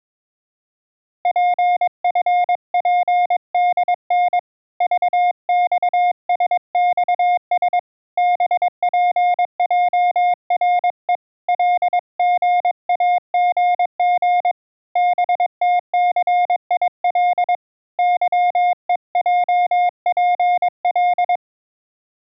Morse code, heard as a keyed tone, hand-sent with a paddle, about 22 wpm, 710 Hz. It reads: PFPDN VXSXS BPJRE LGAGG BTCIL YEJPL